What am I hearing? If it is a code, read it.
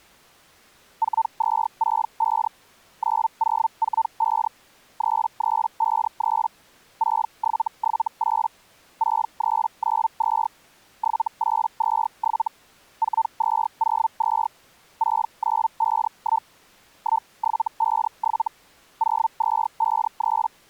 Hellschreiber (Feld-Hell, 122.5 baud), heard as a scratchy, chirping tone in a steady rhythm, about 900 Hz. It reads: 4265 9045 3353 6778 6392 7827 4202 6951 1757 0253